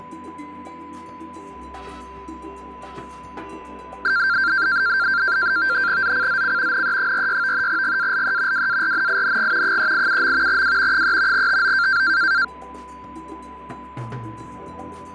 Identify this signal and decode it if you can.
NAVTEX (SITOR-B), 100 baud, 170 Hz shift, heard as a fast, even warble, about 1480 Hz centre, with a steady whistle near 1000 Hz. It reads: ZCZC NE46 GALE WARNING 387. W 3 TO